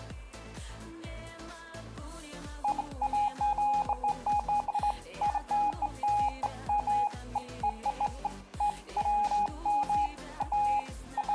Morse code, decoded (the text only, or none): none